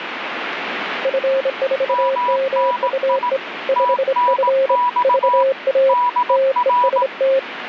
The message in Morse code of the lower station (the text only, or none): F4MUE 5F VA TEST